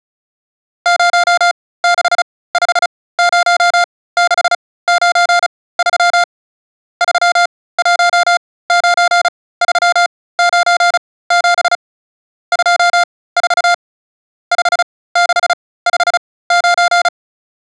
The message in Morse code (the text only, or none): 0650693 319397 24 5659